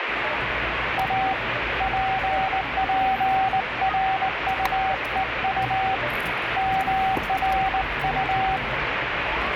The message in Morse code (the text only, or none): A PPRUEU MRU